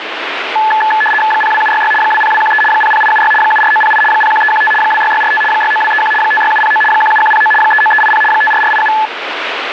RTTY (75 baud, 850 Hz shift), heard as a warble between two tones, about 1290 Hz centre, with radio static. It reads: 02766 20213 00876 74908 01315 26645 69231 56709 17109 39380 54487